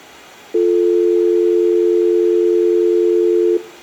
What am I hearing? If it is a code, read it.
Telephone call progress tone (North American or UK plan), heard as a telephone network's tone, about 350, 440 Hz. Dial tone.